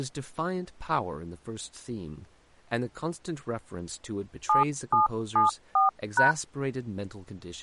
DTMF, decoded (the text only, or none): 7774#